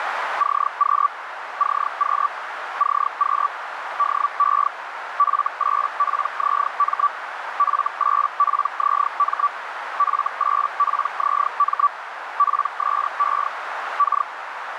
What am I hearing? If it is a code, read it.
Hellschreiber (Feld-Hell, 122.5 baud), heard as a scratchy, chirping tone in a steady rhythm, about 1150 Hz, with radio static and a narrow filter. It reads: CQ CQ CQ DE F8PZM F8PZM F8PZM PSE K